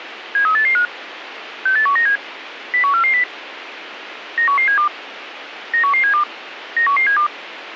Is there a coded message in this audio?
Yes: five-tone selective call (CCIR) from 0.4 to 7.3 s, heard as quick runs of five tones, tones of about 100 ms, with radio hiss. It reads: 73885 68197 01440 91172 91172 91172